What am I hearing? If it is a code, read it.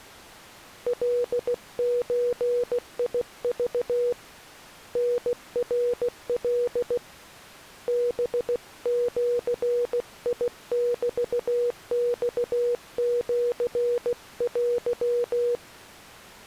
Morse code (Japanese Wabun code), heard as a keyed tone, hand-sent with a paddle, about 16 wpm, 480 Hz. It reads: カゾク タナカ ハジメマシテ